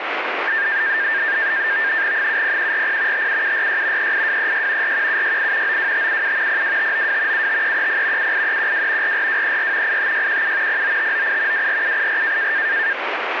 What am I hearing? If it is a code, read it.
NAVTEX (SITOR-B), 100 baud, 170 Hz shift, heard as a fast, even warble, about 1700 Hz centre, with radio static. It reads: 70140 57746 38236 41768 92577 02592 75330 78312 44234 85617 09598 24784